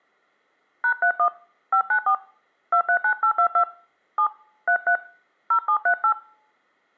DTMF, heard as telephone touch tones, dialled by hand, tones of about 90 ms. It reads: #31 594 239822 7 33 0738